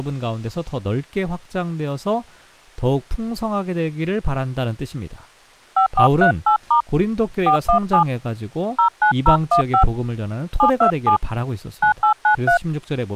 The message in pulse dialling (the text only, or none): none